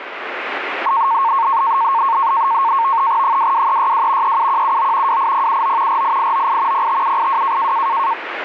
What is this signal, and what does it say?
NAVTEX (SITOR-B), 100 baud, 170 Hz shift, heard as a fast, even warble, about 1000 Hz centre, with radio static. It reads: 22362 37179 28079 48898 05782